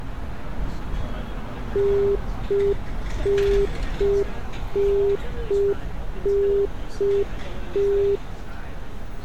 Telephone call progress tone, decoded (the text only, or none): congestion tone